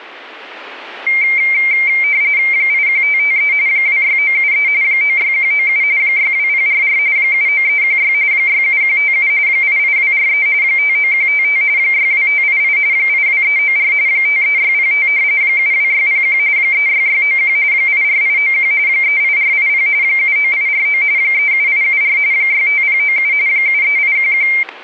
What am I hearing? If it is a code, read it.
RTTY (45.45 baud, 170 Hz shift), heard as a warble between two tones, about 2200 Hz centre, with static crashes. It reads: 81553 26973 96197 62044 79316 67157 88243 59155 62588 82394 53605 72601 36691 84891 38480 79849 37874 65097 73811